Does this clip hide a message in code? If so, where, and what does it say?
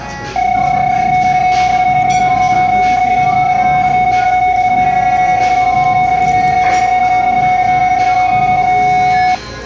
Yes: PSK31 (31.25 baud) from 0.4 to 9.4 s, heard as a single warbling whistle, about 740 Hz, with the noise of a crowd indoors.